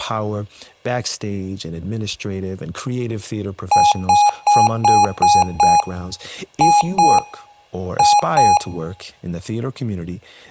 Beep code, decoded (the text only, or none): 6-2-2